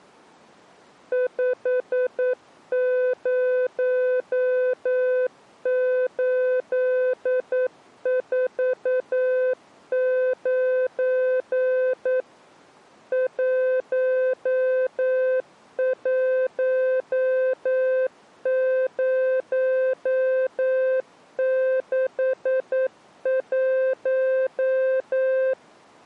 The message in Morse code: 50849 11061

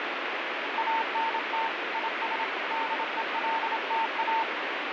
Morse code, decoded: ANT IS DELTA

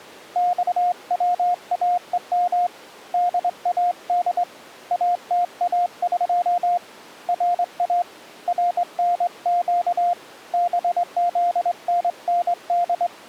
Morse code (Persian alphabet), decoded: خواهم داد اتاق را رنگ بزنند

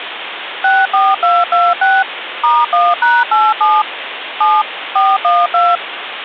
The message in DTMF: 64226 *1#87 7 412

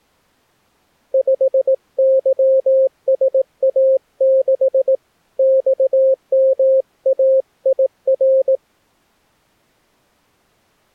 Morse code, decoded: 5YSA6 XMAIR

